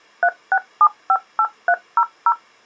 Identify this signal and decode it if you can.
DTMF, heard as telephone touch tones, dialled by machine, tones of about 60 ms. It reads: 36758300